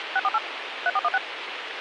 DTMF, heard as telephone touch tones, dialled by machine, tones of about 40 ms, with radio hiss. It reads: 648 3416